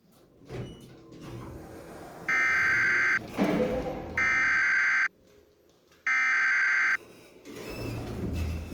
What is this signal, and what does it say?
Emergency Alert System (SAME) tones (header bursts), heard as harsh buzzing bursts, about 520.83 baud, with the noise inside a lift.